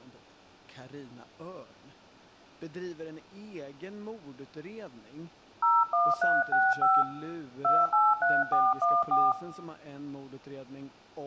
DTMF, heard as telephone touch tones, dialled by hand, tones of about 210 ms, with room echo and speech in Swedish. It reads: 01365 283414